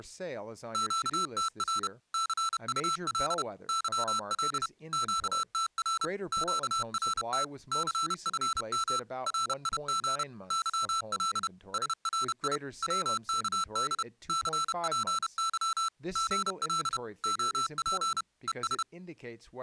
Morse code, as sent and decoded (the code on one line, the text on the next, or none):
--.- - .-. / -.-. ..- .-.. / -.-- .-.. / --.- - .-. / --.- .-. - / -.-. ..-. -- / .-. .. --. / -.-- .-.. / ... .-. .. / .-- -.- -.. / -.-. .--. -.-- / --. .-.. / --- .--. / . ...
QTR CUL YL QTR QRT CFM RIG YL SRI WKD CPY GL OP ES